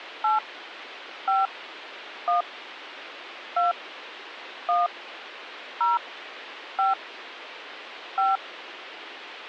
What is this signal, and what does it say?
DTMF, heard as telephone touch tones, dialled by hand, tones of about 150 ms, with phone line noise. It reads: 8 5 1 2 1 0 5 5